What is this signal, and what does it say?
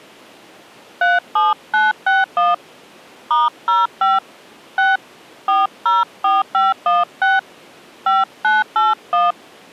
DTMF, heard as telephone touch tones, dialled by hand, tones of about 180 ms. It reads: 37961 *05 6 404516 5981